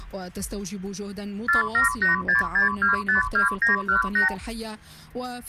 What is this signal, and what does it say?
Multi-frequency trunk signalling (R2, with the far end's replies), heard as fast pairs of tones, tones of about 130 ms, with hum. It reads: 47866252918